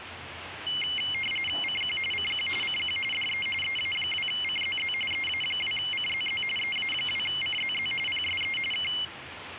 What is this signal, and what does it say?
RTTY (45.45 baud, 850 Hz shift), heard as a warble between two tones, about 2550 Hz centre, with radio static and the noise of a restaurant. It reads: CQ CQ CQ DE EA2CZZ EA2CZZ EA2CZZ PSE K